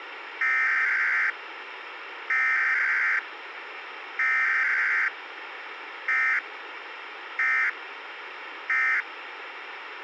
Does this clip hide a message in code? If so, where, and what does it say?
Yes: Emergency Alert System (SAME) tones (header bursts, then end-of-message bursts) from 0.4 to 9.0 s, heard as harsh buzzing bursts, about 520.83 baud, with radio hiss.